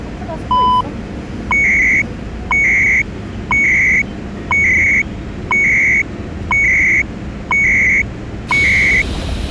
Radio time signal (CHU, Canada), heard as beeps and data bursts, one a second, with the noise inside a subway train.